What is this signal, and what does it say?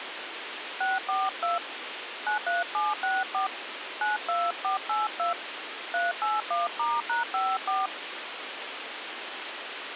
DTMF, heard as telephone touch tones, dialled by hand, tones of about 170 ms, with radio hiss. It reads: 642 93764 92482 381*#54